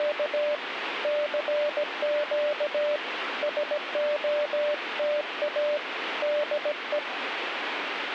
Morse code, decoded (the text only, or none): … CQ SOTA DE